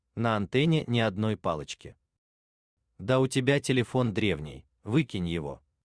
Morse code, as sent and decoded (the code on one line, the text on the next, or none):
none